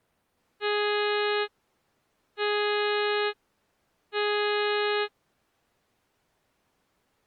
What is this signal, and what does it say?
Ship horn signal, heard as a ship's horn, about 420 Hz. 3 short. At sea: I am operating astern propulsion.